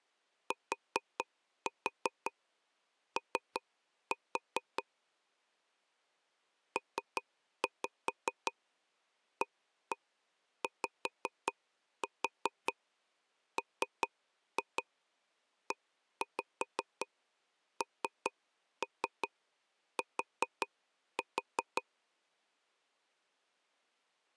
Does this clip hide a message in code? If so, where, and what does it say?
Yes: tap code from 0.5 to 21.8 s, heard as taps on a table, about 5 knocks a second. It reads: TO PAYMENT